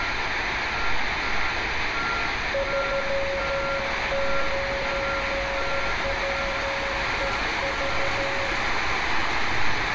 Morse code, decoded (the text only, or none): 39WEV